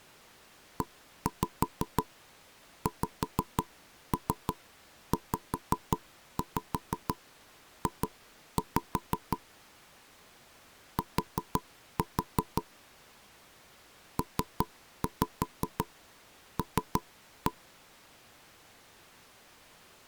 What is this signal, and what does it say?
Tap code, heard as knocks on wood, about 5 knocks a second. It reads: EXZJ T PL